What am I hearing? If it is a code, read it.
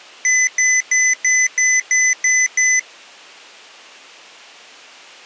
Beep code, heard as beeps from a small speaker, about 2000 Hz. 8 short. In AMI BIOS tables: display memory failure; in Dell tables: LCD failure.